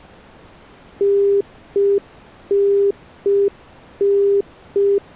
Telephone call progress tone (UK plan), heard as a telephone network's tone, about 400 Hz. Congestion tone.